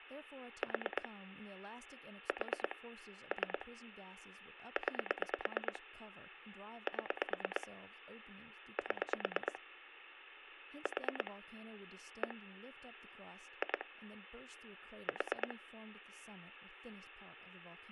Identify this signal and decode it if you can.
Pulse dialling, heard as clicks on a phone line, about 9 pulses a second, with speech in English. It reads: 4 4 3 9 7 7 4 1 2 4